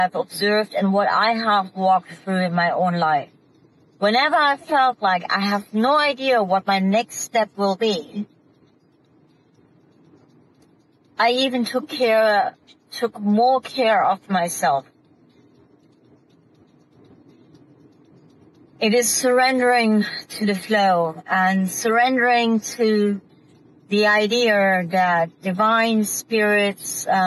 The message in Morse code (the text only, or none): none